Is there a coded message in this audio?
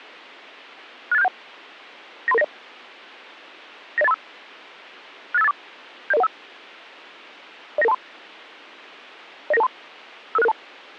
Yes: five-tone selective call (EIA) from 1.1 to 10.5 s, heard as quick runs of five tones, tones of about 30 ms. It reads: 68671 93390 90835 68584 70015 09923 09923 55662